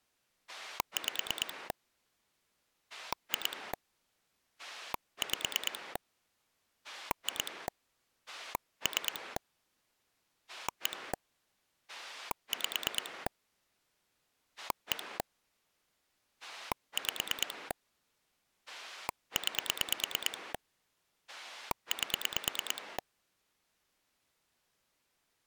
Pulse dialling, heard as a rotary dial, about 9 pulses a second. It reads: 5 2 5 2 3 1 5 1 5 9 8